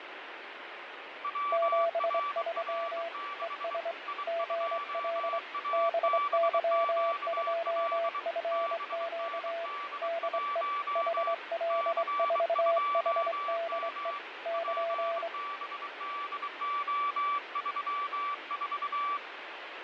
Morse code, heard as two keyed tones, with radio static and fading. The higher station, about 23 wpm, 1160 Hz: WRR6 I2ABQL BND1 C2M PBDO34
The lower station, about 24 wpm, 670 Hz: 73 ES GL BY2FQ DE HL4HDE <KN>